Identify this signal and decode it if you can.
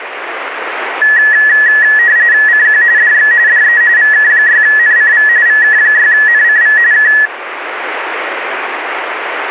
RTTY (45.45 baud, 170 Hz shift), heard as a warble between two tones, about 1800 Hz centre, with radio static. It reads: CQ DX DE VK6NCV VK6NCV K